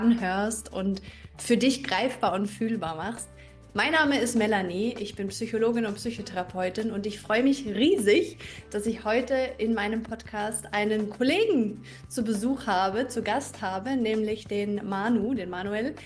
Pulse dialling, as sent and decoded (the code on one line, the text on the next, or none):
none